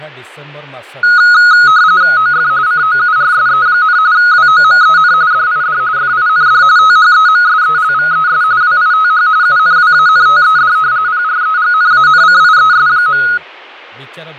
RTTY (45.45 baud, 170 Hz shift), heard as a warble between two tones, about 1360 Hz centre, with fading and speech in Odia. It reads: OF COURSE, WOMEN DID FIND THEMSELVES WITH UNWANTED PREGNANCIES.